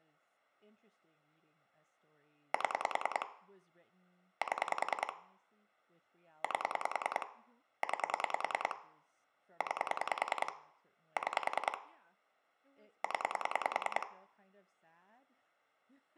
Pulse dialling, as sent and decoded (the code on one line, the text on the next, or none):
7 / 7 / 8 / 9 / 9 / 6 / 10
7 7 8 9 9 6 0